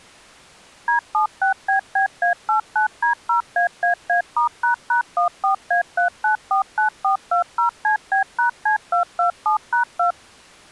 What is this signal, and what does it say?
DTMF, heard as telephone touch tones, dialled by machine, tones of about 110 ms. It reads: D76BBA89D0AAA*##14A3949420CB#C227#2